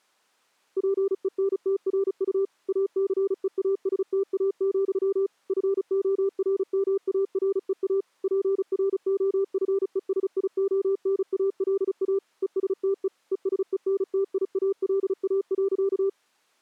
Morse code, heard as a keyed tone, machine-sent, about 35 wpm, 400 Hz. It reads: PENTRU ACEASTA, FORMAREA PROFESIONALA ESTE ESENTIALA.